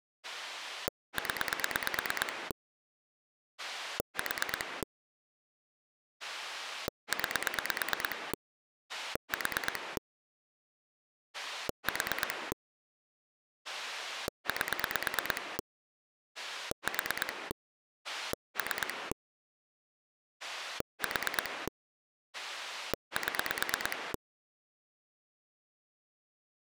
Pulse dialling, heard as a rotary dial, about 9 pulses a second. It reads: 0 4 9 4 4 8 4 3 4 7